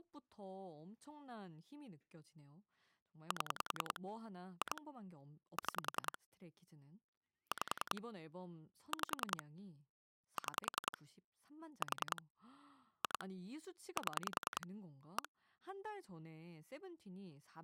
Pulse dialling, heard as clicks on a phone line, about 10 pulses a second, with speech in Korean. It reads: 7 2 6 5 5 6 4 2 7 1